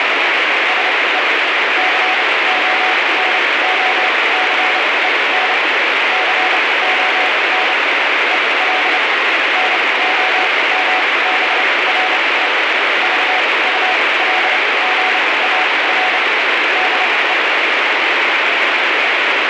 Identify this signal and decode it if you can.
Morse code, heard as a keyed tone, machine-sent, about 29 wpm, spaced as for 21 wpm, 740 Hz, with heavy radio static. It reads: SE CONOCEN CON EL NOMBRE VULGAR DE